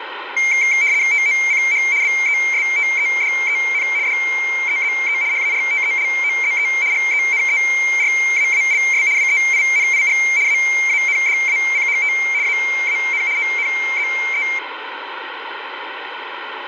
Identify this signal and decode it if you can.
RTTY (75 baud, 170 Hz shift), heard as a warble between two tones, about 2200 Hz centre, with radio static and room echo. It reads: TOCH BESTEDEN DEZE HARTELOZE GENERAALS WEINIG AANDACHT AAN ONZE